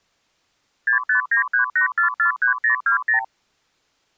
Multi-frequency trunk signalling (R2, with the far end's replies), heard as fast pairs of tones, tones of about 110 ms. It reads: 65938443020